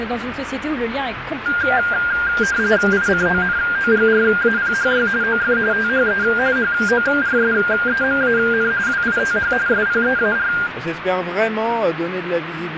RTTY (45.45 baud, 170 Hz shift), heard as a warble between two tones, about 1500 Hz centre, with radio static. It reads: ICONOGRAPHY OF THE HORSEMAN WITH SPEAR